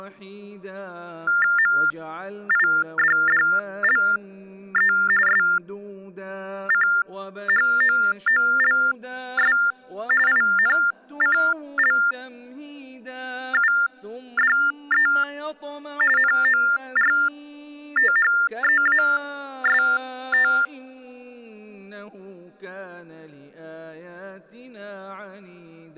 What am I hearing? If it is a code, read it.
TTY/TDD text telephone tones (45.45 baud Baudot), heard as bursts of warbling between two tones, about 400 Hz shift, 1600 Hz centre. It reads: MIDDLE SCHOOLS INCLUDE NORTHEAST